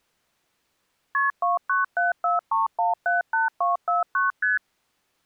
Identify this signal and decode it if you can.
Multi-frequency trunk signalling (R1, as on North American trunks), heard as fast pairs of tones, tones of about 150 ms. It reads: KP 29743178249 ST